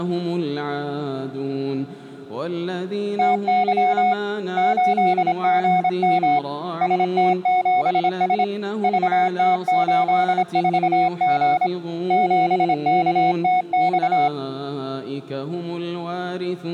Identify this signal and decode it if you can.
Morse code, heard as a keyed tone, hand-sent with a paddle, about 26 wpm, 730 Hz. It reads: TY 8GM ST7S VT84G 7KTX